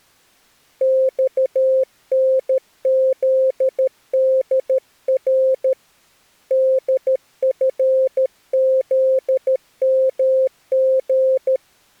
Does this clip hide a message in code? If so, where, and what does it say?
Yes: Morse code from 0.8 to 11.6 s, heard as a keyed tone, hand-sent with a paddle, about 13 wpm, 520 Hz. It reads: XNZDR DFZMG